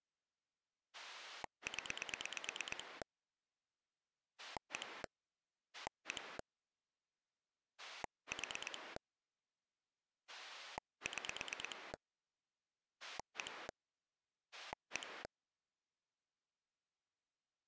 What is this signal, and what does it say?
Pulse dialling, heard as a rotary dial, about 8 pulses a second. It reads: 0 1 1 4 6 1 1